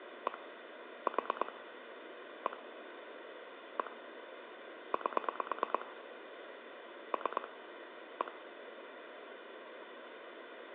Pulse dialling, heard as clicks on a phone line, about 9 pulses a second, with phone line noise. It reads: 1 4 1 1 8 3 1